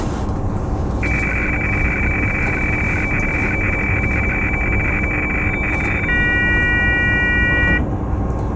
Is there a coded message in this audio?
Yes: weather fax (radiofax), 120 lines a minute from 1.0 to 7.8 s, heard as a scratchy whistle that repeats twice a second, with the noise inside a bus.